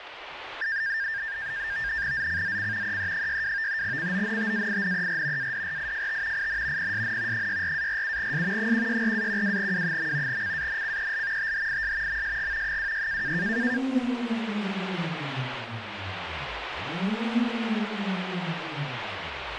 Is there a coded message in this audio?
Yes: NAVTEX (SITOR-B), 100 baud, 170 Hz shift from 0.6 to 13.8 s, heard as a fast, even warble, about 1700 Hz centre, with radio static. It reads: ZCZC EE62 CONTAINER ADRIFT IN PSN 64-47S 164-12W. CANCEL THIS MSG 26